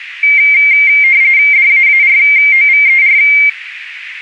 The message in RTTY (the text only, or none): DAAROVER